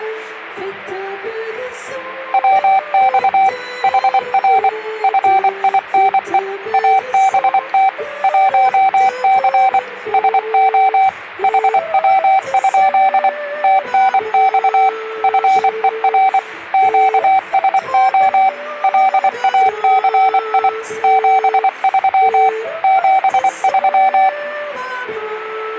Morse code, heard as a keyed tone, machine-sent, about 24 wpm, 770 Hz. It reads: WX HR FINE ABT 1C SO HW? TNX FER QSO LACI 73 73